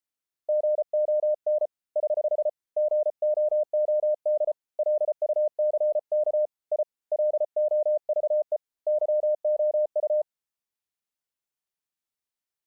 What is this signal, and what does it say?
Morse code, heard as a keyed tone, hand-sent with a paddle, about 34 wpm, 610 Hz. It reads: GON <HH> GOOD LUCK I LOVE YOU